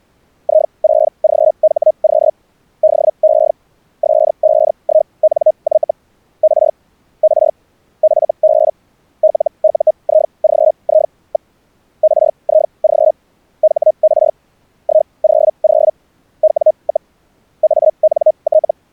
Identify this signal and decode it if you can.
Hellschreiber (Feld-Hell, 122.5 baud), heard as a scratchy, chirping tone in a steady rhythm, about 620 Hz. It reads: I6GHQ DE S51NY R R FB LUIGI. RIG HR 100 W, ANT